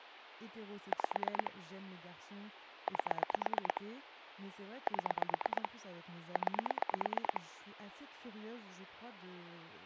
Pulse dialling, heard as clicks on a phone line, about 8 pulses a second, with phone line noise and speech in French. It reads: 5 8 7 9